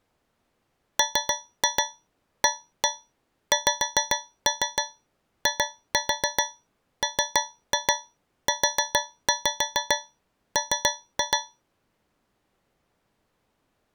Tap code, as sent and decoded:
3-2 1-1 5-3 2-4 3-2 4-5 3-2
MAXIMUM

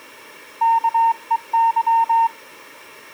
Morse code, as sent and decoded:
-.- . -.--
KEY

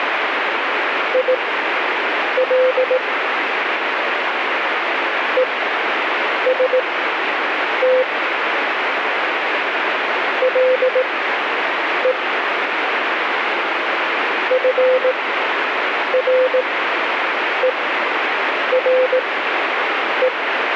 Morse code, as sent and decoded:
.. .-.. / . ... - / .-.. . / ..-. .-. . .-. .
IL EST LE FRERE

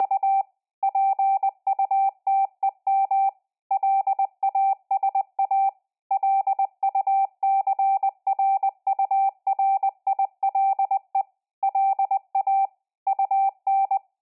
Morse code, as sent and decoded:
… / .--. ..- - . -- / .-.. .- ... .- / .-.. ..- -.-. .-. ..- .-. .. .-.. . / .-.. .- / ..- -.
… PUTEM LASA LUCRURILE LA UN

